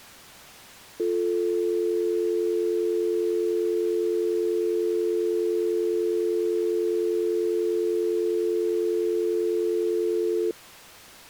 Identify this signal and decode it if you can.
Telephone call progress tone (North American or UK plan), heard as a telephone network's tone, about 350, 440 Hz. Dial tone.